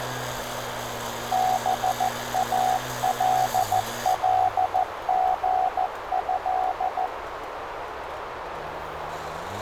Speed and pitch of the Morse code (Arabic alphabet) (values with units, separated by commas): 14 wpm, 750 Hz